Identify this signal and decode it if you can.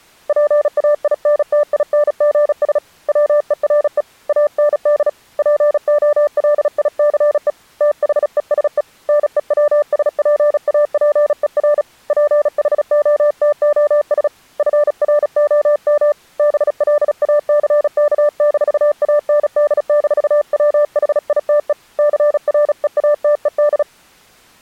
Morse code, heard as a keyed tone, hand-sent with a paddle, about 36 wpm, 590 Hz. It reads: PAINTINGS WERE AND POLICE THESE NEWSPAPER PHOTOS FROM BLACK-AND-WHITE CREATED